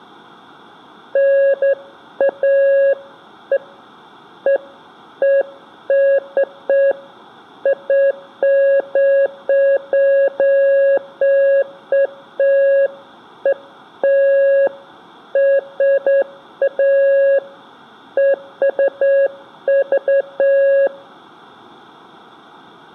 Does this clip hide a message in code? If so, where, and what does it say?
No, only beeps of irregular length, with room echo.